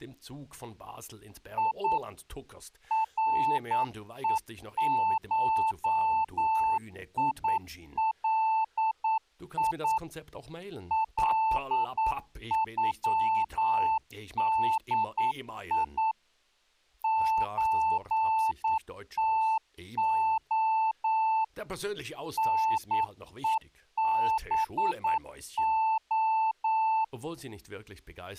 Morse code (Russian alphabet), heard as a keyed tone, machine-sent, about 9 wpm, 880 Hz, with speech in German. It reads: И РЕШИЛИ ЛЮДИ ЧТО НЕБО